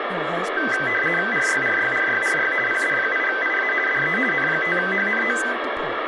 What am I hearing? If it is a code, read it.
RTTY (50 baud, 450 Hz shift), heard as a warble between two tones, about 1800 Hz centre, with radio static and speech in English. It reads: RYRYRYRY PD8IA DE N5HNO